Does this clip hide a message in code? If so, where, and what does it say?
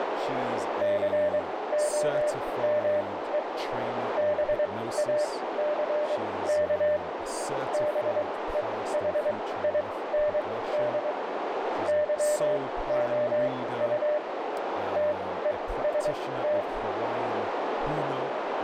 Yes: Morse code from 0.8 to 16.7 s, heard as a keyed tone, machine-sent, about 23 wpm, spaced as for 16 wpm, 600 Hz, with heavy radio static, a narrow filter and speech in English. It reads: COME BACK BEHIND YOU TEST